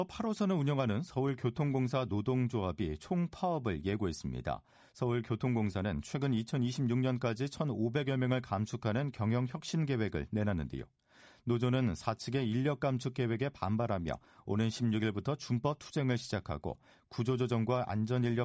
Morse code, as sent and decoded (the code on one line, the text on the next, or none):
none